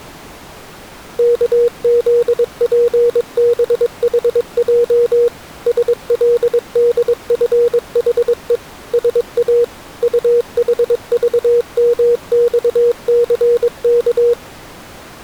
Morse code, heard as a keyed tone, machine-sent, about 22 wpm, 480 Hz. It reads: KZPBHJ SLDFHE SA UHVMXCK